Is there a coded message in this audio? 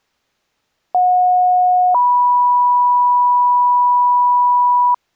Yes: two-tone page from 0.9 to 4.9 s, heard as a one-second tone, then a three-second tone, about 730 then 980 Hz.